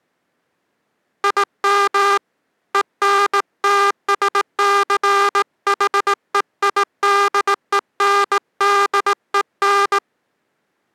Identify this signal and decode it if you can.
Morse code, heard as a buzzer, hand-sent with a straight key, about 18 wpm. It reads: IM ENTSCHEIDENDEN